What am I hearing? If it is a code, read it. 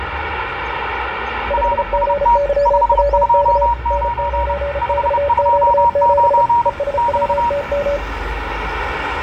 Morse code, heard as two keyed tones, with radio static, room echo and street noise. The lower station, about 34 wpm, 570 Hz: 5GYWK N9XQ7 ESWTM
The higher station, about 30 wpm, 950 Hz: RST 529 529 <BT>